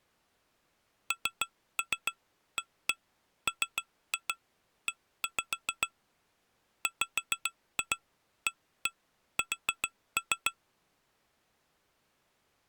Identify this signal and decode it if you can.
Tap code, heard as taps on glass, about 7 knocks a second. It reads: NAME WAS